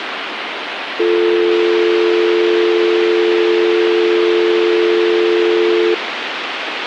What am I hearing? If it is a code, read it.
Telephone call progress tone (North American or UK plan), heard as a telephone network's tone, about 350, 440 Hz, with phone line noise. Dial tone.